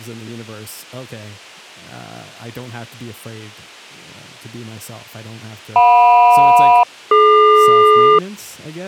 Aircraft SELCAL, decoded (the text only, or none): JM-DQ